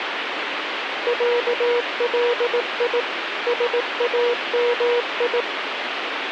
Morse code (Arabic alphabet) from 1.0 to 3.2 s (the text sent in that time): علي